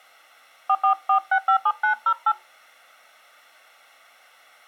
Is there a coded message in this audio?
Yes: DTMF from 0.7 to 2.3 s, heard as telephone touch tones, dialled by hand, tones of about 80 ms. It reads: 444657908